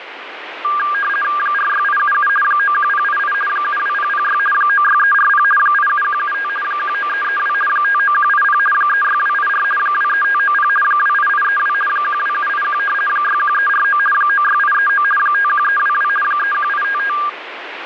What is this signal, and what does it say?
RTTY (50 baud, 450 Hz shift), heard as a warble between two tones, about 1400 Hz centre, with radio static. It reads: 46877 91088 72006 96340 87175 19332 59180 36284 23590 28832 12781 61349 96839 51322 31855